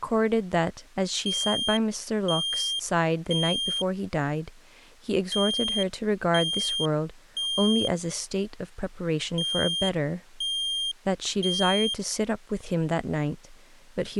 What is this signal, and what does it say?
Alarm pattern, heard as an alarm's beeps, played three times, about 3200 Hz, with speech in English. Temporal three. Smoke or fire, evacuate.